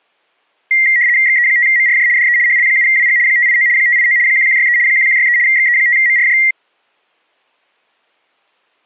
RTTY (75 baud, 170 Hz shift), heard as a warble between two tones, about 2000 Hz centre. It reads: XE5MRJ DE HL7WG 589 589 1163 1163 XE5MRJ